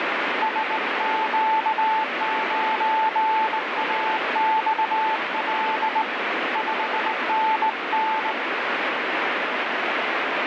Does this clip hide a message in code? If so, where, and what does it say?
Yes: Morse code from 0.4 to 8.4 s, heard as a keyed tone, hand-sent with a straight key, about 19 wpm, 880 Hz, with heavy radio static. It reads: SQ9AXL 5NN